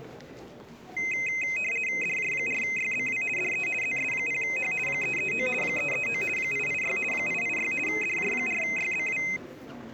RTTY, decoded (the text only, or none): DJ4YBW DE ZS0H 339 339 886 886 DJ4YBW